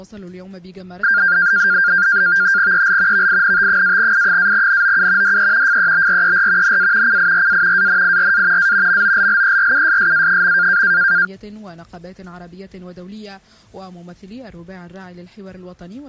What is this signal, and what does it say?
NAVTEX (SITOR-B), 100 baud, 170 Hz shift, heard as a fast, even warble, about 1500 Hz centre. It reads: EL VINT-I-NOU DE FEBRER NA CIRA ANIRA A MOLLERUSSA.